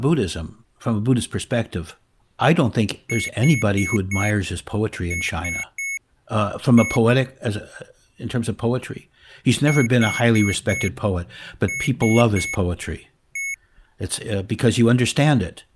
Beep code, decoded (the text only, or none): 4-3-1